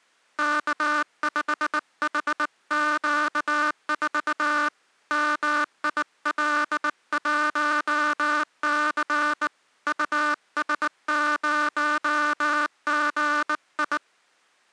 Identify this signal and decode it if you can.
Morse code, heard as a buzzer, hand-sent with a bug key, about 19 wpm. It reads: K5HQ4 MIL1C US0GI